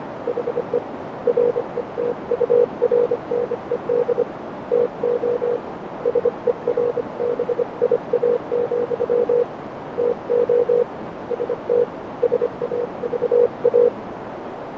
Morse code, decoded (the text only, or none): HE RETURNED TO SERBIA, TO ST SAVA